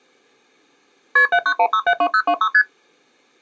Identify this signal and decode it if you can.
Multi-frequency trunk signalling (R1, as on North American trunks), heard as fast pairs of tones, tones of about 70 ms. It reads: KP 791672026 ST